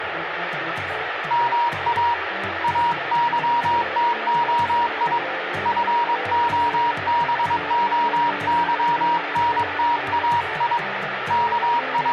Morse code (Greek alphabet), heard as a keyed tone, hand-sent with a paddle, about 22 wpm, 950 Hz, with radio static and room echo. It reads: ΜΑ ΑΥΤΟΙ ΦΟΒΟΥΝΤΑΙ …